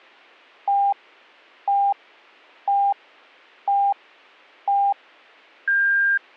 Radio time signal (five pips and a higher one, as on Chinese radio), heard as pips.